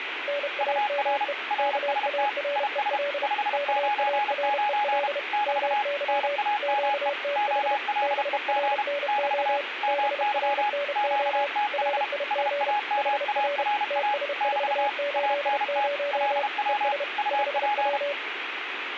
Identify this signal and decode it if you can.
Morse code, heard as two keyed tones, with radio static. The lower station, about 31 wpm, 570 Hz: NAME KAREL KAREL MY QTH BRNO BRNO RIG HR TS480 ES 5W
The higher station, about 32 wpm, 830 Hz: UR RST IS 599 <BT> NAME OLEG <BT> MY QTH SAMARA <BT> ANT LW UP